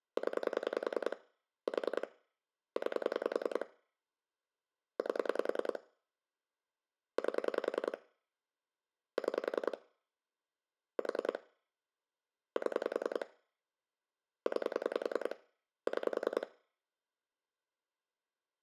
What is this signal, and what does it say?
Pulse dialling, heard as clicks on a phone line, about 10 pulses a second, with room echo. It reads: 0 4 9 8 8 6 4 7 9 6